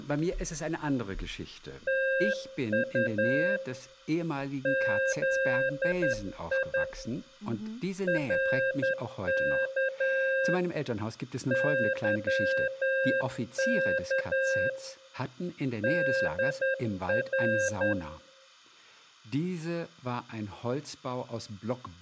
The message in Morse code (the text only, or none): TU ZI RK YK DR